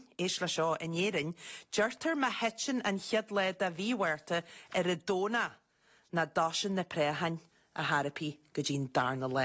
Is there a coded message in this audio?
No, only speech in English.